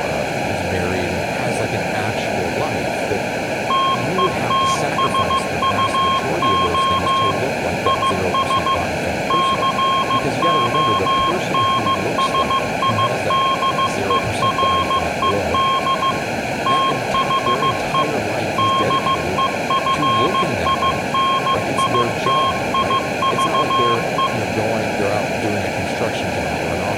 Morse code, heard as a keyed tone, machine-sent, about 15 wpm, 1070 Hz, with room echo and speech in English. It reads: TETSUO IS CONSIDERED THE DEFINITIVE